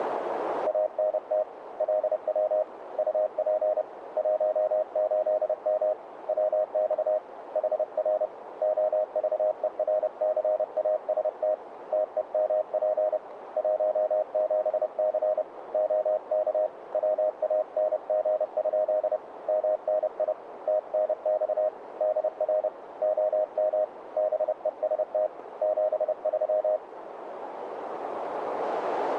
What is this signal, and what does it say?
Morse code, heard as a keyed tone, hand-sent with a paddle, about 30 wpm, 620 Hz, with radio static and a narrow filter. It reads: ANT LW UP 18M WX HR OVERCAST TEMP 17C OK WANG? MNI TNX DR OM BEST 73